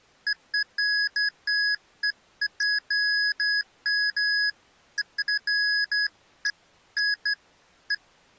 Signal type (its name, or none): none